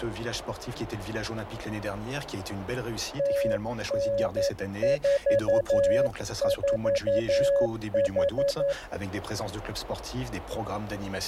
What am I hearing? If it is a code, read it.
Morse code, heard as a keyed tone, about 11 wpm, 560 Hz. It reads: TN44H